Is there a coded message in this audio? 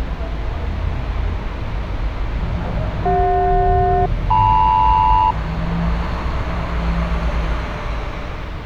Yes: aircraft SELCAL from 3.1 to 5.3 s, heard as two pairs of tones, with street noise. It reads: CJ-LM